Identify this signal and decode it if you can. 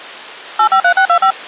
DTMF, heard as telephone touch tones, dialled by machine, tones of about 80 ms. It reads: 853625